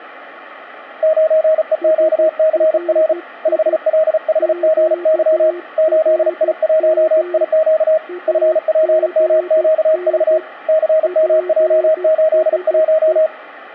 Morse code, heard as two keyed tones. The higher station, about 35 wpm, 630 Hz: 9EQCR 5LHGY 8I1IQ FPMQV CMJ81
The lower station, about 13 wpm, 360 Hz: SRI QRM AGN PSE